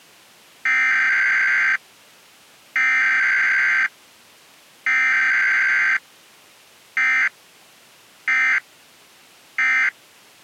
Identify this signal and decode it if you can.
Emergency Alert System (SAME) tones (header bursts, then end-of-message bursts), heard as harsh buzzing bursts, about 520.83 baud.